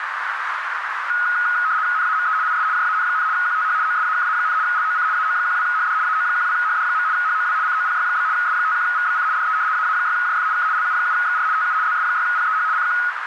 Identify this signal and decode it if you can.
RTTY (75 baud, 170 Hz shift), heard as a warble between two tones, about 1360 Hz centre, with radio static and a narrow filter. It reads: NAME IS JAN, QTH OSAKA, LOC AO12HD AO12HD. HOW COPY? S51VBC DE AA6JF K LU7XR TU ZS6PEH CQ